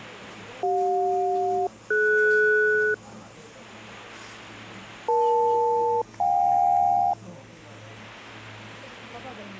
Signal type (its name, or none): aircraft SELCAL